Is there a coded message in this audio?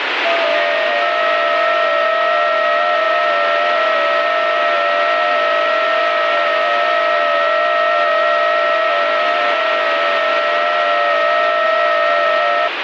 Yes: FT8 (several signals at once) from 0.2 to 12.7 s, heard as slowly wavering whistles, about 6.25 baud, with radio static.